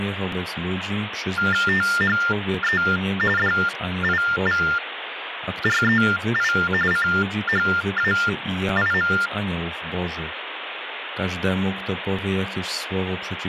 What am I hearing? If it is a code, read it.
TTY/TDD text telephone tones (45.45 baud Baudot), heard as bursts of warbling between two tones, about 400 Hz shift, 1600 Hz centre, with phone line noise and speech in Polish. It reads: THE DIVREI CHAIM